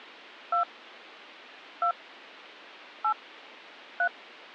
DTMF, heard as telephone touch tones, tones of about 100 ms. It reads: 2 2 8 3